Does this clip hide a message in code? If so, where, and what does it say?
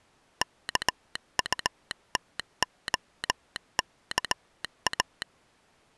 Yes: Morse code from 0.4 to 5.3 s, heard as a telegraph sounder, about 18 wpm. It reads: KUTOKA